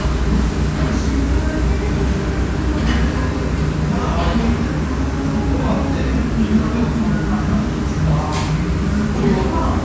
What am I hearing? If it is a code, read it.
The noise of a restaurant. There is no code.